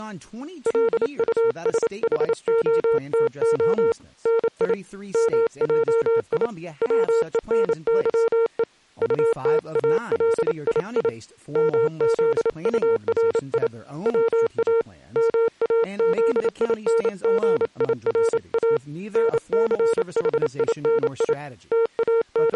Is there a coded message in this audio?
Yes: Morse code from 0.6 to 22.6 s, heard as a keyed tone, hand-sent with a paddle, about 28 wpm, 460 Hz, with speech in English. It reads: LUSHOTO NI MJI WENYE UTALII MZURI WA MAZINGIRA NCHINI …